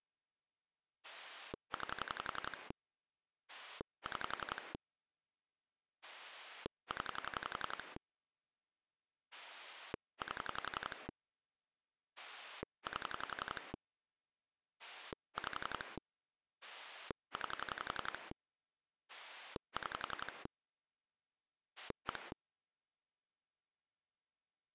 Pulse dialling, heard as a rotary dial, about 11 pulses a second. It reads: 9 6 0 8 8 5 9 6 1